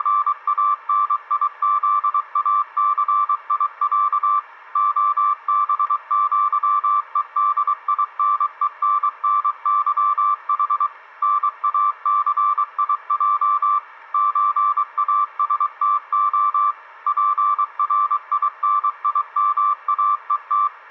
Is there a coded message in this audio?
Yes: Morse code (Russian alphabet) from 0.0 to 20.7 s, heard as a keyed tone, machine-sent, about 23 wpm, 1170 Hz. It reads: … ОБЪЕДИНЕННЫХ НАЦИЙ ЧАСТО ПРИНИМАЕТ